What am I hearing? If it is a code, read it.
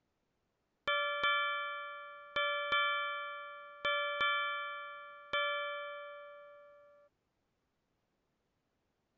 Ship's bell, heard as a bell. 7. Seven half-hours of the watch have passed.